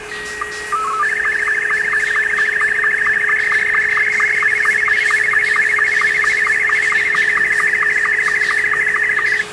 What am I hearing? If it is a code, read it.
SSTV (slow-scan television), Martin M2, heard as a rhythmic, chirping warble, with radio static, a steady whistle near 420 Hz and the noise of a restroom.